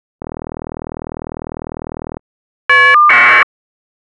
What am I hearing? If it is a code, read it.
Caller ID data burst, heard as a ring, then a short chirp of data, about 1200 baud.